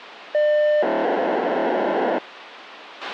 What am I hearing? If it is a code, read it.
POCSAG pager data (1200 baud), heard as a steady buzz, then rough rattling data, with radio hiss and a squelch burst at the end.